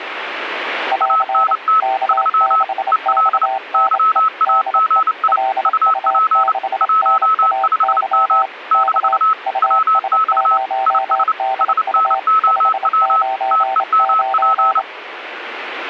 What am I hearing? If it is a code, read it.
Morse code, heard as two keyed tones, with radio static. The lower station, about 27 wpm, 780 Hz: <AR> K6XNE DE LU6NAY K US0DU 599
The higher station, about 29 wpm, 1300 Hz: ANT 3 EL YAGI UP 15M - WX IS SNOW TEMP